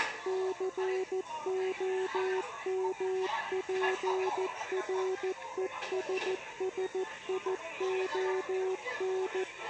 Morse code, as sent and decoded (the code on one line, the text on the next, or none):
-.-. --- -- .--. .-. . ... ... .. --- -.
COMPRESSION